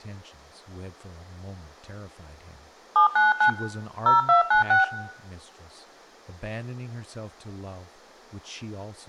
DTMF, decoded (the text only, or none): 799 0296